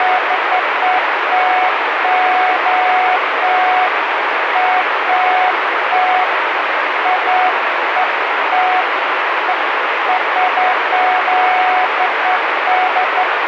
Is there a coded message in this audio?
No, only beeps of irregular length, with heavy radio static.